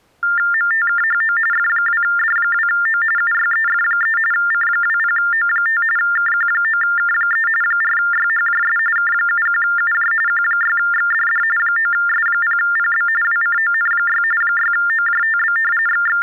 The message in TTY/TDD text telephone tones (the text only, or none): MTKHO F2D2O UYEF3 C20O5 KQ9K3 4YHJS K71UJ Q6XDD 9S0PB WCON6 6OJTB …